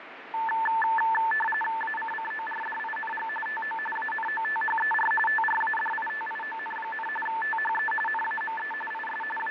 RTTY (45.45 baud, 850 Hz shift), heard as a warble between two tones, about 1320 Hz centre, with radio static and fading. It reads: ACCORDING TO ANOTHER TRADITION, THE NAME IS …